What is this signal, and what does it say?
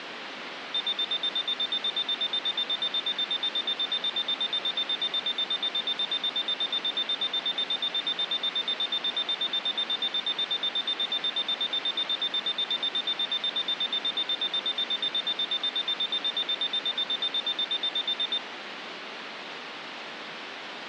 Evenly repeated beeps, with phone line noise. There is no code.